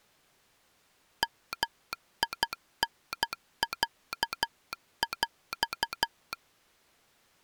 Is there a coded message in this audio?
Yes: Morse code (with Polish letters) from 1.2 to 6.4 s, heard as a telegraph sounder, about 12 wpm. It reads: MINĄŁ